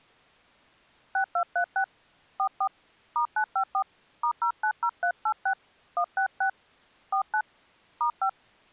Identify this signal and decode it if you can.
DTMF, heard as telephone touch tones, dialled by hand, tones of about 80 ms. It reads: 6236 44 *954 *090386 166 49 *5